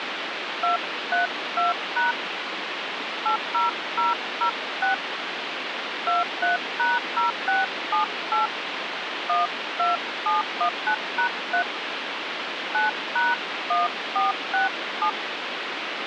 DTMF, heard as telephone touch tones, dialled by hand, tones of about 140 ms, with phone line noise. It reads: 232# 80006 23#0678 12719#3 9#1467